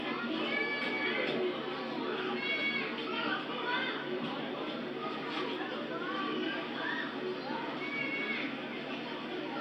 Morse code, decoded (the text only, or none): none